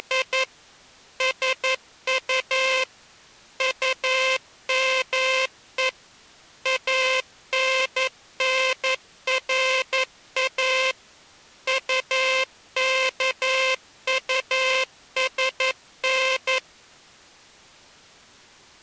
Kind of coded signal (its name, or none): Morse code